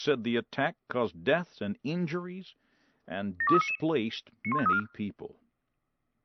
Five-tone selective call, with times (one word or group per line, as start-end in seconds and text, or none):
3.4-3.8 72399
4.4-4.8 91534